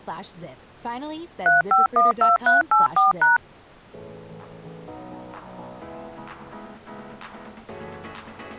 DTMF, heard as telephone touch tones, dialled by machine, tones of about 150 ms. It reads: 3512384#